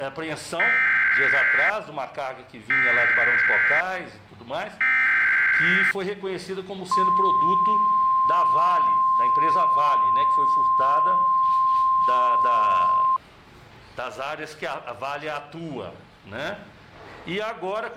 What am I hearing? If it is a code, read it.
Emergency Alert System (SAME) tones (header bursts, then the 1050 Hz attention tone), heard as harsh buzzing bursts, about 520.83 baud.